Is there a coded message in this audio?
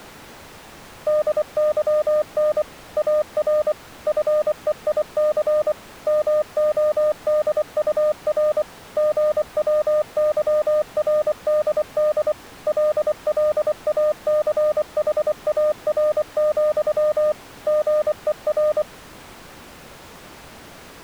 Yes: Morse code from 1.0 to 18.9 s, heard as a keyed tone, machine-sent, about 24 wpm, 610 Hz. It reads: DYN AR FEIC MODUR GWYRDD LLACHAR, GER